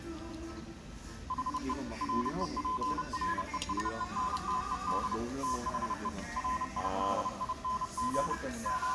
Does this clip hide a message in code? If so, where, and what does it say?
Yes: Morse code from 1.2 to 8.9 s, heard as a keyed tone, hand-sent with a paddle, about 30 wpm, 1020 Hz, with the noise of a restaurant. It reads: HE REPRESENTED THE RIDING …